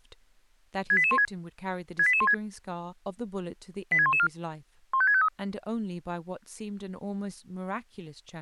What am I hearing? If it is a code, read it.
Five-tone selective call (ZVEI), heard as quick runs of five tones, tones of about 70 ms, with speech in English. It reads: 68816 68816 86114 15653